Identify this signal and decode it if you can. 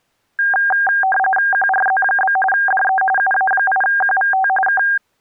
RTTY (45.45 baud, 850 Hz shift), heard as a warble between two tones, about 1190 Hz centre. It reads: QRZ? DE UA8QVT K